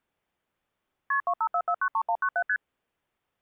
Multi-frequency trunk signalling (R1, as on North American trunks), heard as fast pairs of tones, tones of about 70 ms. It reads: KP 254493197 ST